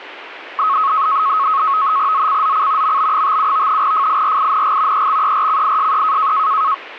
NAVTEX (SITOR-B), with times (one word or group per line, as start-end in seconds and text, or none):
2.1-3.0 ZCZC
2.8-3.8 MB57
3.8-5.1 FIRING
4.9-6.3 EXERCISE